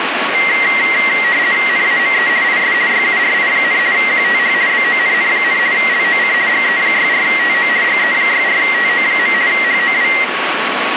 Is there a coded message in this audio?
Yes: RTTY (50 baud, 170 Hz shift) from 0.3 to 10.2 s, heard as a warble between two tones, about 2000 Hz centre, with radio static. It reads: NAME IS YURI, QTH BONN, LOC GE64TO GE64TO. HOW